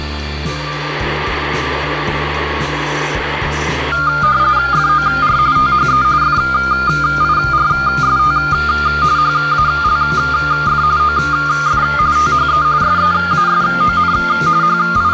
RTTY (45.45 baud, 170 Hz shift), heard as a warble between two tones, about 1310 Hz centre. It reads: FOR THE FIRST HALF OF THE SEASON …